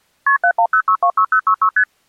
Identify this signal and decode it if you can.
Multi-frequency trunk signalling (R1, as on North American trunks), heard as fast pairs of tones, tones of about 80 ms. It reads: KP 710626066 ST